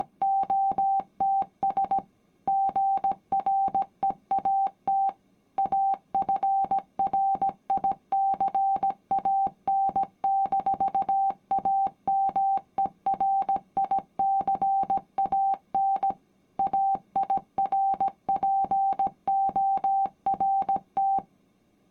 Morse code, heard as a keyed tone, machine-sent, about 17 wpm, 780 Hz. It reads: … GREAT AFRICAN-AMERICAN AIRPORT